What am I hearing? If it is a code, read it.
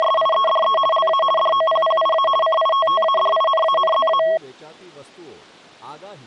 RTTY (50 baud, 450 Hz shift), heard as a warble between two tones, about 870 Hz centre, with speech in Gujarati. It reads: … LA DOPPIA CITTADINANZA